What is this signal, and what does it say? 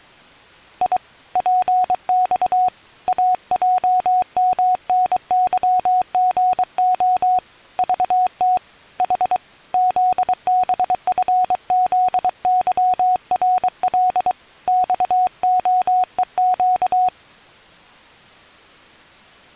Morse code, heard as a keyed tone, hand-sent with a paddle, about 23 wpm, 740 Hz. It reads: I PX AJMNYGO VT H ZBFZYRL XOEQ